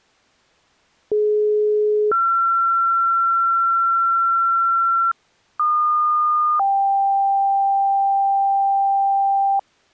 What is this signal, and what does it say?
Two-tone page, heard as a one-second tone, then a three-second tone, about 420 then 1360 Hz, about 1220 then 790 Hz.